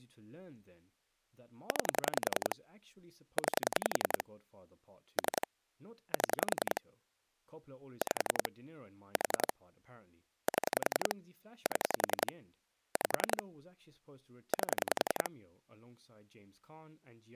Pulse dialling, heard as clicks on a phone line, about 10 pulses a second, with speech in English. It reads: 9 9 3 7 5 4 7 7 5 8